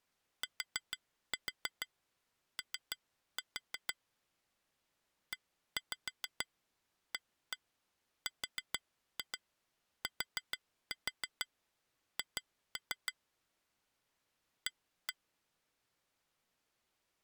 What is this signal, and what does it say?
Tap code, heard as taps on glass, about 6 knocks a second. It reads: TO EARTH A